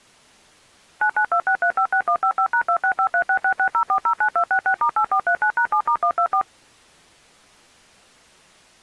DTMF, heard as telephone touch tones, dialled by machine, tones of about 80 ms. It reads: 9926356155#26536660409266*8439#7*124